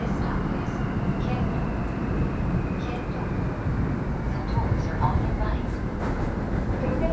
The noise inside a subway train. There is no code.